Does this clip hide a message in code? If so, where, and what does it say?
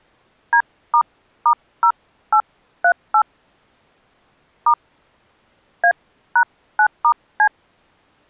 Yes: DTMF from 0.5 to 7.5 s, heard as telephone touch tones, dialled by hand, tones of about 80 ms. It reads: D**0838 * A#9*C